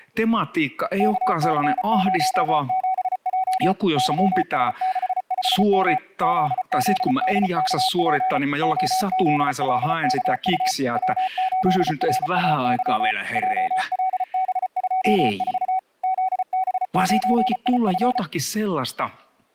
Morse code, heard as a keyed tone, machine-sent, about 34 wpm, 760 Hz, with speech in Finnish. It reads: KC07J YS65M ZZDKP OZLKU W8RAY JLB24 ZB9IF